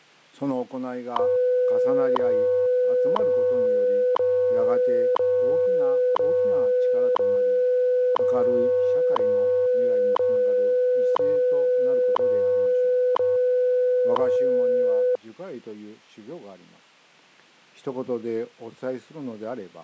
Radio time signal (WWV, Colorado), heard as ticks, one a second.